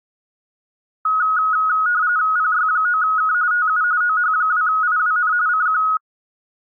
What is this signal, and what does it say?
RTTY (45.45 baud, 170 Hz shift), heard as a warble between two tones, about 1360 Hz centre. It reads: PY9K TU OH2IWN CQ